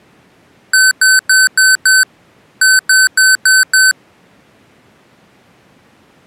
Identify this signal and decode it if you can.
Beep code, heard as beeps from a small speaker, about 1550 Hz. 5-5.